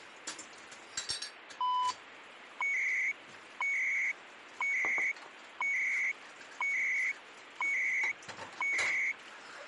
Radio time signal (CHU, Canada), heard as beeps and data bursts, one a second, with radio static and kitchen noise.